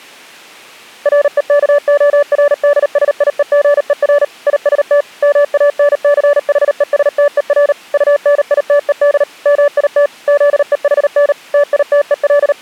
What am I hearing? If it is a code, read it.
Morse code, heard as a keyed tone, machine-sent, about 38 wpm, 580 Hz. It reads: REKORDSIEGER IST MANCHESTER UNITED MIT ZEHN …